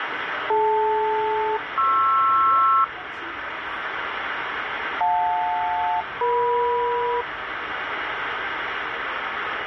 Aircraft SELCAL, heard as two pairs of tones, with radio static and the noise inside a subway train. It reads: DL-PR JL-EM